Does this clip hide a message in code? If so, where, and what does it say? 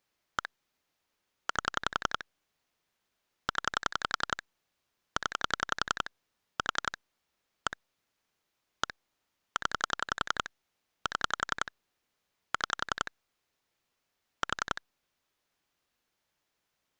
Yes: pulse dialling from 0.4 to 14.8 s, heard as clicks on a phone line, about 11 pulses a second. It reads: 1 8 0 0 4 1 1 0 7 6 4